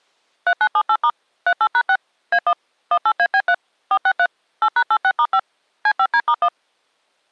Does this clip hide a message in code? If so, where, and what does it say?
Yes: DTMF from 0.5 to 6.5 s, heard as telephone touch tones, dialled by machine, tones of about 60 ms. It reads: 3978* 38#6 A1 18AB3 463 8#86*5 C5D*1